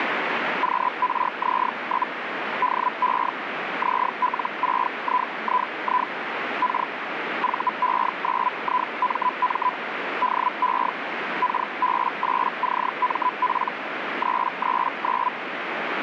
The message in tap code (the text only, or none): none